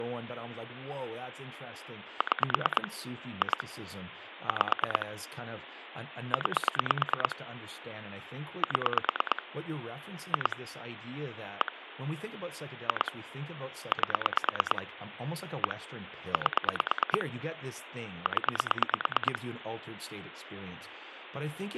Pulse dialling, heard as clicks on a phone line, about 9 pulses a second, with phone line noise and speech in English. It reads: 6 2 5 9 7 2 1 2 8 1 8 0